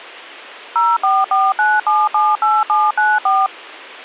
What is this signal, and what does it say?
DTMF, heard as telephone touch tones, dialled by machine, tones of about 210 ms. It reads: 0449778794